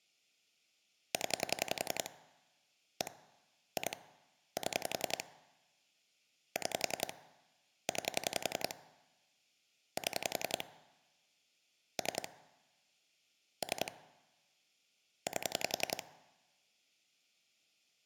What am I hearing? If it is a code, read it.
Pulse dialling, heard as clicks on a phone line, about 11 pulses a second. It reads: 0 1 2 7 6 9 7 3 3 8